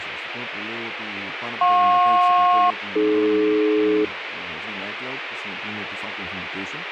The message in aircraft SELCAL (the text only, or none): JP-AD